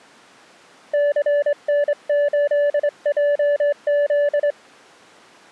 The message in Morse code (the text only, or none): CN8JZ